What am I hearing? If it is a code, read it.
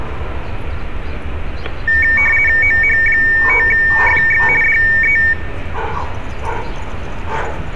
RTTY (50 baud, 450 Hz shift), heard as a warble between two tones, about 2050 Hz centre, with static crashes and street noise. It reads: OH5FX DE